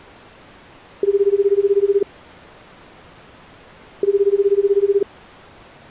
Telephone call progress tone (Japanese plan), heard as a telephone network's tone, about 380, 400, 420 Hz, 1 s on and 2 s off. Ringback tone.